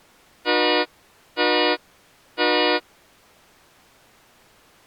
Train horn signal, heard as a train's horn. 3 short. On North American railways: when stopped, the train will back up.